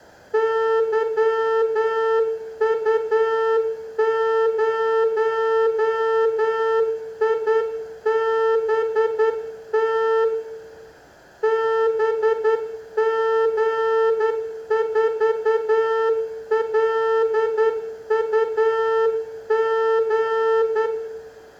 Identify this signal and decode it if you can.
Morse code, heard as a horn, hand-sent with a straight key, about 10 wpm, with room echo. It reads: YU0IBT BG4LUG